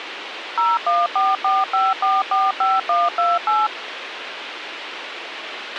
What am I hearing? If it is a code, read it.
DTMF, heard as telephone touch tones, dialled by machine, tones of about 200 ms, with radio hiss and a squelch burst at the end. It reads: 01445445128